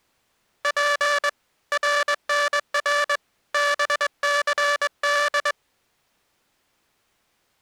Morse code, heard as a buzzer, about 21 wpm. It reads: P RNR BCD